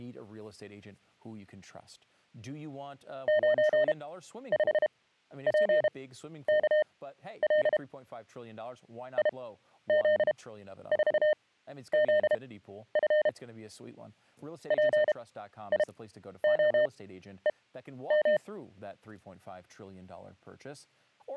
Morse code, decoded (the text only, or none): 95PKL IZ4ZF PIOEM